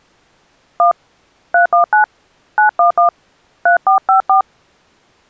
DTMF, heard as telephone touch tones, dialled by hand, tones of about 120 ms. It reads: 1 319 911 3454